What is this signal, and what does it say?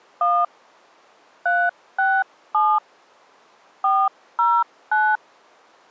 DTMF, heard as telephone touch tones, dialled by hand, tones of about 240 ms. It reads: 1 367 409